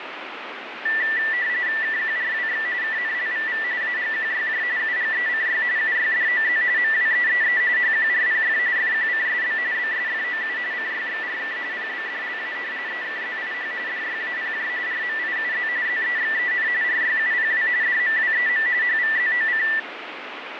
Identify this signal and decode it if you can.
RTTY (45.45 baud, 170 Hz shift), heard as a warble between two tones, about 1850 Hz centre, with radio static and fading. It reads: KQRWX KNLVV AGQYJ UGECY UYDOZ MWEEE HQRPF FQCSB BSFOU CYXRK PBDLA EKZIH DYAPJ RMIUZ ZEXEN RYUPW DMWEM HVZOC